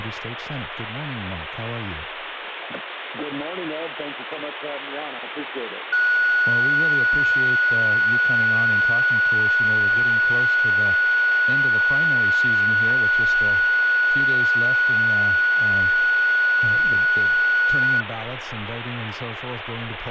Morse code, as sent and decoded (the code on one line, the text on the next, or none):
none